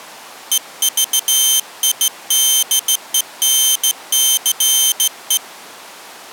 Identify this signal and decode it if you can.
Morse code, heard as a high beeper, hand-sent with a straight key, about 15 wpm, 3100 Hz. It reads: EVIDENCE